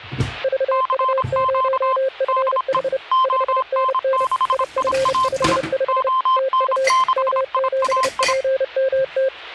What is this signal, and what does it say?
Morse code, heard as two keyed tones, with kitchen noise. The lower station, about 30 wpm, 530 Hz: VU0FH 5NN IF55 TU M7PMT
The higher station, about 26 wpm, 1040 Hz: CQ DE ON6IAI ON6IAI